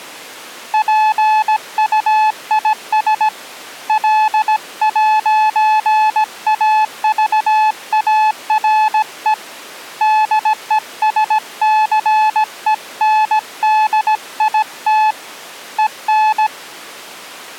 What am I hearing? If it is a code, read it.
Morse code, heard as a keyed tone, hand-sent with a paddle, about 17 wpm, 860 Hz. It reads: PUIS L'AVARE DESCENDIT EN